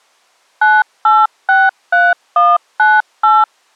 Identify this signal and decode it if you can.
DTMF, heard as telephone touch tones, dialled by machine, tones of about 210 ms. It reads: 9863198